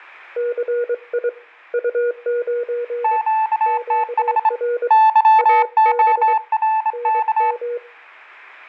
Morse code, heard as two keyed tones, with room echo. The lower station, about 23 wpm, 480 Hz: CI U9 QR AB NM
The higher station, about 25 wpm, 880 Hz: QTH YORK